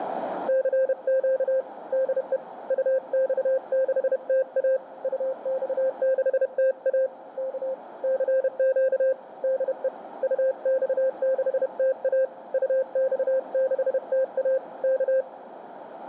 Morse code, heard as a keyed tone, hand-sent with a paddle, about 31 wpm, 530 Hz, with radio static and a narrow filter. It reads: CQ DE UX6TA UX6TA K CQ DE UX6TA UX6TA K